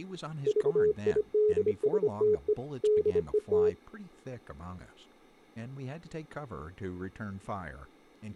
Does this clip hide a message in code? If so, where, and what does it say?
Yes: Morse code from 0.4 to 3.8 s, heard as a keyed tone, hand-sent with a bug key, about 25 wpm, 420 Hz, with speech in English. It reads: VIDSTE DET